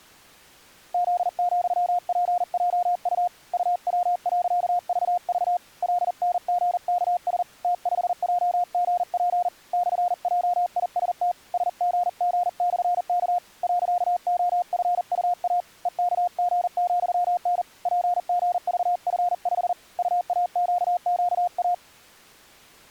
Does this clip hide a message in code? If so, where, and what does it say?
Yes: Morse code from 0.9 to 21.8 s, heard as a keyed tone, hand-sent with a paddle, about 40 wpm, 710 Hz. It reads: Z,PJU UW.VV LNGKS T5JGP /JIST SGG/K .OFUA EKG,N PGVF5 UAQQA